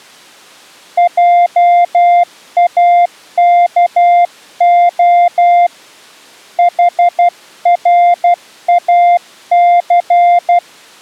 Morse code, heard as a keyed tone, hand-sent with a paddle, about 12 wpm, 700 Hz. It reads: JAKO HRAC